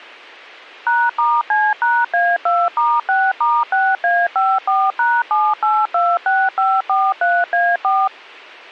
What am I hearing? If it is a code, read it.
DTMF, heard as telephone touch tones, dialled by machine, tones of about 230 ms. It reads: #*C#A2*6*6A54#7826543A4